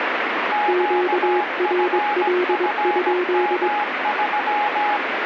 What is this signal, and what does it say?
Morse code, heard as two keyed tones, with radio static. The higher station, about 17 wpm, 830 Hz: QFFM3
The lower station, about 22 wpm, 360 Hz: QRL?